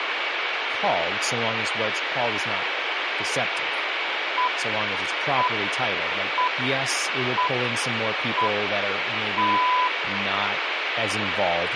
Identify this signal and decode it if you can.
Radio time signal (six pips, as the Greenwich Time Signal), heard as pips, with radio static, a steady whistle near 2270 Hz and speech in English.